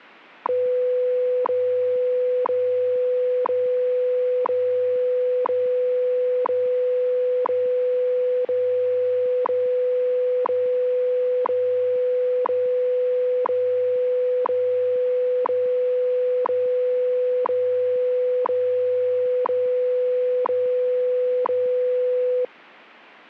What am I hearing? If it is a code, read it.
Radio time signal (WWV, Colorado), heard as ticks, one a second.